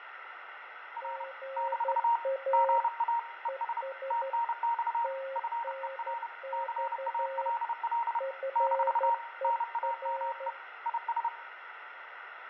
Morse code, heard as two keyed tones, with radio static, fading and room echo. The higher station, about 30 wpm, 940 Hz: R - GA ES TNX FER CALL - NAME IS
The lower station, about 12 wpm, 540 Hz: GA ES TNX FER